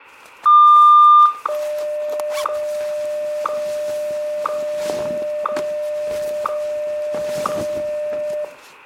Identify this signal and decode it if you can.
Radio time signal (WWVH, Hawaii), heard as ticks, one a second, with room echo.